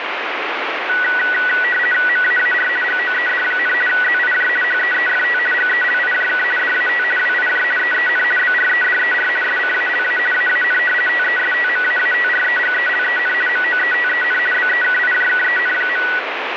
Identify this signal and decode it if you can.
RTTY (50 baud, 450 Hz shift), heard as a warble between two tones, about 1700 Hz centre, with radio static. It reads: MAAR GOED, ZIJ HEEFT GELIJK DAT WIJ EEN BREDER SCALA AAN TESTMAATREGELEN MOETEN BEKIJKEN.